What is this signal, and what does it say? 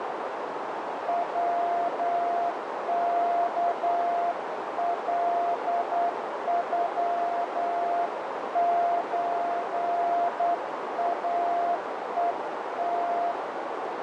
Morse code (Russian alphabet), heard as a keyed tone, hand-sent with a straight key, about 9 wpm, 690 Hz, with heavy radio static and a narrow filter. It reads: ВКЛЮЧАЕТ